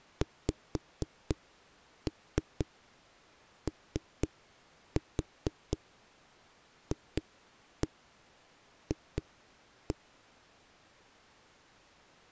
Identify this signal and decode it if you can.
Tap code, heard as knocks on a wall, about 4 knocks a second. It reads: XOFF